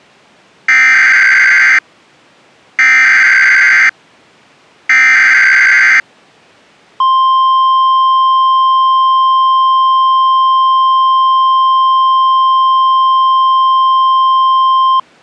Emergency Alert System (SAME) tones (header bursts, then the 1050 Hz attention tone), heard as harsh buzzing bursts, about 520.83 baud.